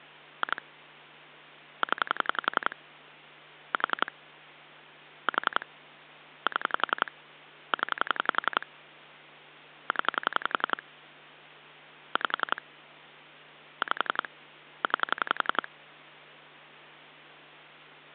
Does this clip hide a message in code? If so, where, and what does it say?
Yes: pulse dialling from 0.4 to 15.7 s, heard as clicks on a phone line, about 11 pulses a second, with hum. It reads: 2 0 4 4 7 0 0 5 5 9